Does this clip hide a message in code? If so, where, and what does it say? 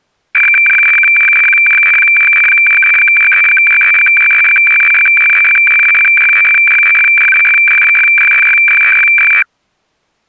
Yes: weather fax (radiofax), 120 lines a minute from 0.3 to 9.4 s, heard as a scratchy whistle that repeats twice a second.